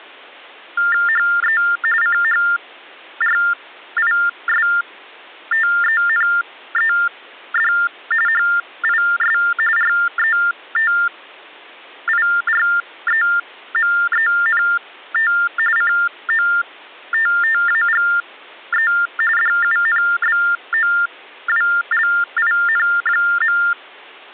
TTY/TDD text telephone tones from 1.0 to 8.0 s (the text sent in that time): HE CHRISTENED